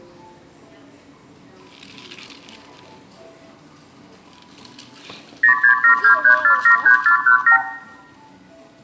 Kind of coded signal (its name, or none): multi-frequency trunk signalling